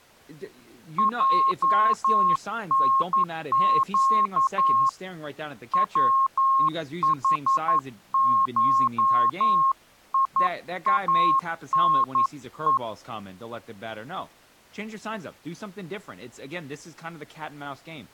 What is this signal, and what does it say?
Morse code (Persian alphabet), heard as a keyed tone, hand-sent with a paddle, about 11 wpm, 1080 Hz, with speech in English. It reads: جنگ وحشیانه